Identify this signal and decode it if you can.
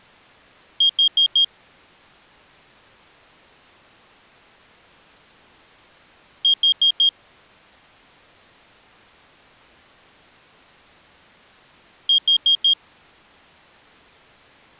Alarm pattern, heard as an alarm's beeps, played three times, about 3250 Hz. Temporal four. Carbon monoxide.